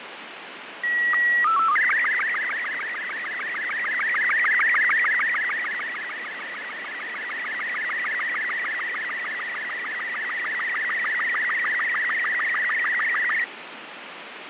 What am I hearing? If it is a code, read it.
SSTV (slow-scan television), Robot 36, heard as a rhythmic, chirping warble, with heavy radio static and fading.